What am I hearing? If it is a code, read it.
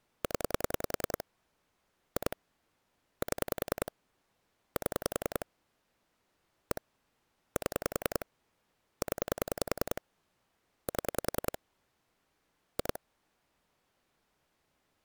Pulse dialling, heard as clicks on a phone line, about 10 pulses a second. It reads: 0 2 7 7 1 7 0 7 2